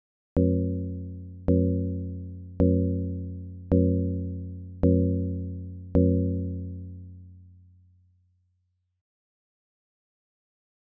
Clock strike, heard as a bell. 6. Six o'clock.